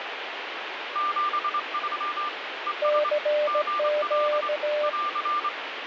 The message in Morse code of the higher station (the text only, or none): 73 ES GL <AR>